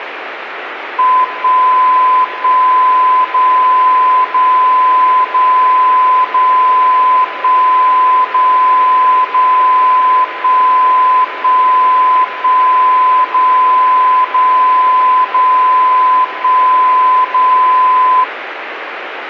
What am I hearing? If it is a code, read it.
Radio time signal (DCF77), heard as a tone whose level steps once a second, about 1020 Hz, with radio static. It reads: 1 1 0 0 0 0 1 0 0 1 1 1 0 0 0 1 0